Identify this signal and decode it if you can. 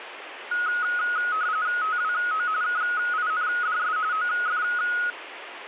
RTTY (45.45 baud, 170 Hz shift), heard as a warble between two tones, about 1360 Hz centre, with radio static. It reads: TWO KINDS OF